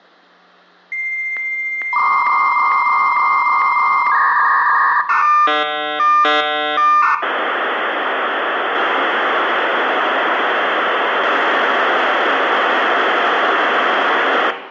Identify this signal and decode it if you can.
Dial-up modem handshake (V.34 or later), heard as a whistle, warbles, then hiss, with room echo.